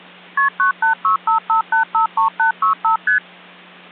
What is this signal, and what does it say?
Multi-frequency trunk signalling (R1, as on North American trunks), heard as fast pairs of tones, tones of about 110 ms, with hum. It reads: KP 98655853865 ST